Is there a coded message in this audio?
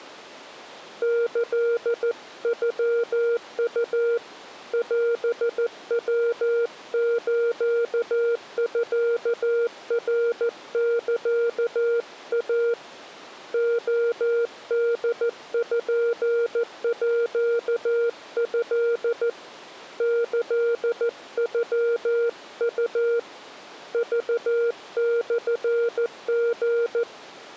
Yes: Morse code (Japanese Wabun code) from 1.0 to 27.1 s, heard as a keyed tone, hand-sent with a paddle, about 14 wpm, 470 Hz. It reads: キノウ オヤスミナサイ レポート キノウ クモリ